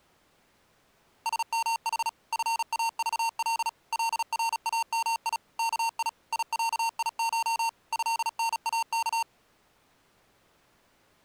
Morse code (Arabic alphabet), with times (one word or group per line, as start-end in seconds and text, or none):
1.3-2.1 سمح
2.3-3.7 فاضل
3.9-5.4 لرامي
5.6-6.1 كي
6.3-7.7 يعيش
7.9-9.2 هناك